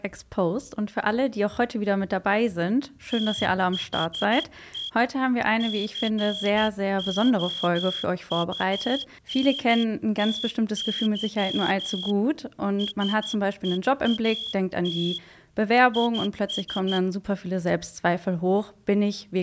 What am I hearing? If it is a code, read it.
Morse code, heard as a whistle, hand-sent with a straight key, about 12 wpm. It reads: THE COUNTY SEAT IS